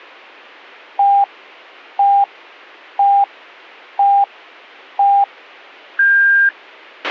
Radio time signal (five pips and a higher one, as on Chinese radio), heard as pips, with a squelch burst at the end.